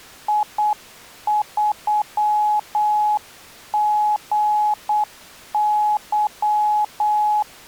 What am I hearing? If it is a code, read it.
Morse code, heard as a keyed tone, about 8 wpm, 840 Hz. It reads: I3GY